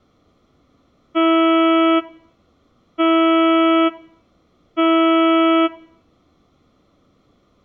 Ship horn signal, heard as a ship's horn, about 330 Hz, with room echo. 3 short. At sea: I am operating astern propulsion.